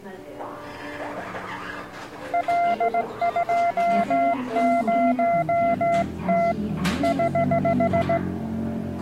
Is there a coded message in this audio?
Yes: Morse code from 2.3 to 8.2 s, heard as a keyed tone, hand-sent with a straight key, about 17 wpm, 680 Hz, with the noise of a cafe. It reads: L20T <HH>